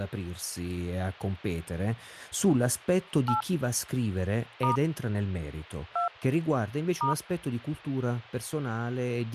DTMF, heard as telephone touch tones, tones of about 120 ms, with speech in Italian. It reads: 8 * 2 *